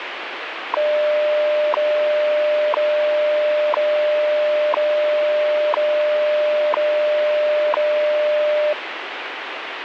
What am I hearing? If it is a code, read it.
Radio time signal (WWV, Colorado), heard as ticks, one a second, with radio static.